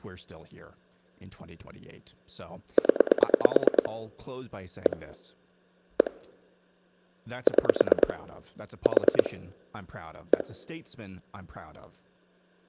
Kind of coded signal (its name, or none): pulse dialling